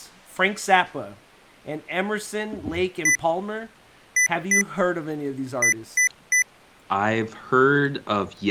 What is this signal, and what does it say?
Beep code, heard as beeps from a small speaker, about 2000 Hz, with speech in English. 1-2-3. In Phoenix BIOS tables: DMA page register failure.